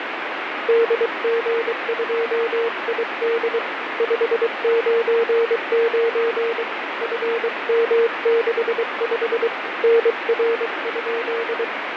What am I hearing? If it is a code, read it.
Morse code, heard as a keyed tone, hand-sent with a paddle, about 23 wpm, 460 Hz, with radio static and fading. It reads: DG2ID 599 FM65 NR?